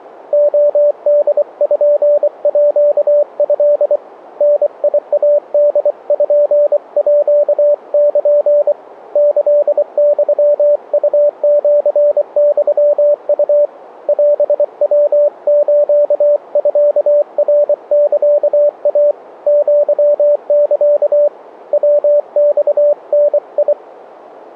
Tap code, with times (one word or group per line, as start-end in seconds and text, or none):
none